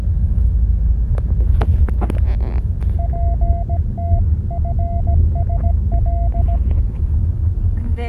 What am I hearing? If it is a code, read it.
Morse code (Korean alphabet), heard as a keyed tone, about 17 wpm, 690 Hz, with the noise inside a car. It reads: 저녁